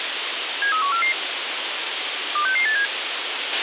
Five-tone selective call (CCIR), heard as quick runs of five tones, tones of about 100 ms, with radio hiss and a squelch burst at the end. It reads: 73144 26687